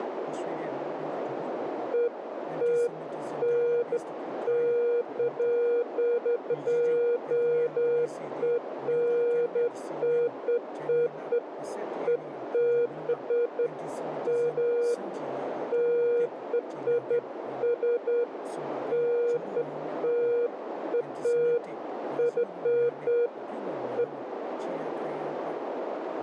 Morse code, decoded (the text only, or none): none